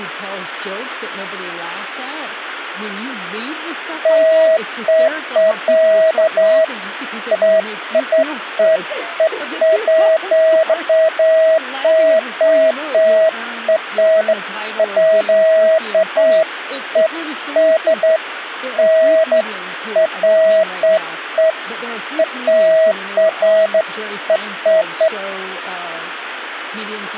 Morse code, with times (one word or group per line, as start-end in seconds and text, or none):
none